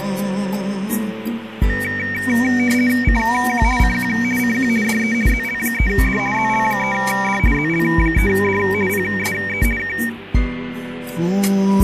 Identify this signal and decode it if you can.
RTTY (50 baud, 450 Hz shift), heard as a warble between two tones, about 2050 Hz centre, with radio static. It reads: CQ CQ CQ DE ZL3D ZL3D ZL3D PSE K